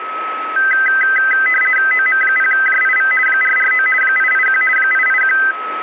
RTTY (50 baud, 450 Hz shift), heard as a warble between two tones, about 1800 Hz centre, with radio static and a steady whistle near 1290 Hz. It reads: OM0JIV 449 881 881